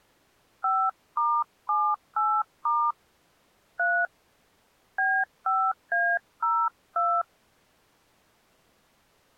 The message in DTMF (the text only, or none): 5*78* 3 B5A02